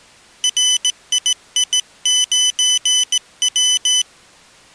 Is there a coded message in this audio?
Yes: Morse code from 0.4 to 4.1 s, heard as a high beeper, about 17 wpm, 3000 Hz. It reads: RII9W